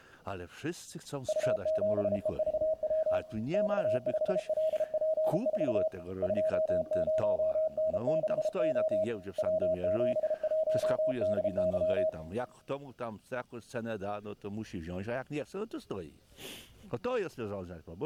Morse code, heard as a keyed tone, hand-sent with a paddle, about 33 wpm, 630 Hz, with room echo. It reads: U7EVW X5LP4 20N6O W71DY